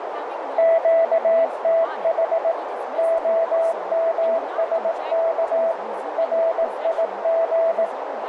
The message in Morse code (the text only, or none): QTH OMSK RIG